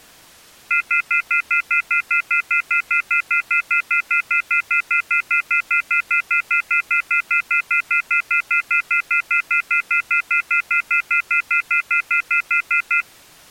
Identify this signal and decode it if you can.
Telephone call progress tone (North American plan), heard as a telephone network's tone, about 1400, 2050, 2450, 2600 Hz, 0.1 s on and 0.1 s off. Off-hook warning tone.